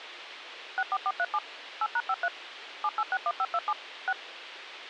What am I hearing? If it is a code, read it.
DTMF, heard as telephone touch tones, dialled by machine, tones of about 50 ms, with radio hiss. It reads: 64437 8#53 7861527 6